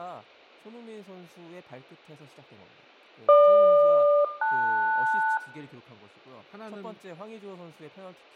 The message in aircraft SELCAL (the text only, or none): GQ-LS